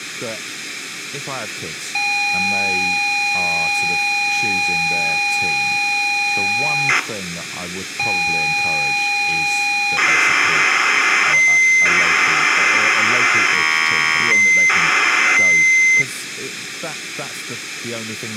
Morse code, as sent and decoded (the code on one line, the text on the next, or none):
none